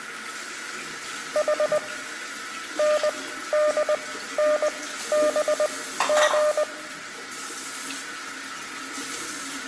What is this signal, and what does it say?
Morse code, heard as a keyed tone, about 20 wpm, spaced as for 13 wpm, 600 Hz, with room echo and the noise of a restroom. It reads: H NDNBG